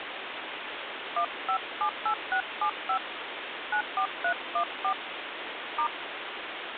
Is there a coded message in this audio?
Yes: DTMF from 1.2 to 5.9 s, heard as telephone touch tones, dialled by hand, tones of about 80 ms, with phone line noise. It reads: 1578675 94314 *